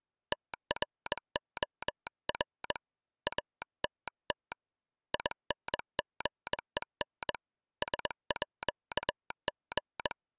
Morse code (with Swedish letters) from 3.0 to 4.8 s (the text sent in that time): ATT